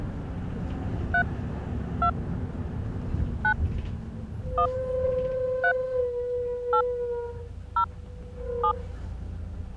DTMF, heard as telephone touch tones, dialled by hand, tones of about 80 ms, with the noise inside a bus. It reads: 3 2 9 1 3 8 0 7